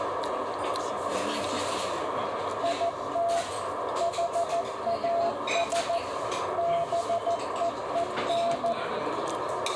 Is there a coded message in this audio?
Yes: Morse code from 2.6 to 8.8 s, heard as a keyed tone, machine-sent, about 14 wpm, 680 Hz, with radio static, a narrow filter and the noise of a restaurant. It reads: IT HAS BEEN